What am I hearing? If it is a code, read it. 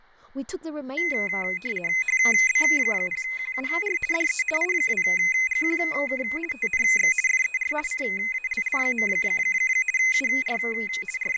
RTTY (50 baud, 450 Hz shift), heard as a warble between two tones, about 2300 Hz centre, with fading, room echo and speech in English. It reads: HB0QUR DE I2GQK TNX FER CALL. UR …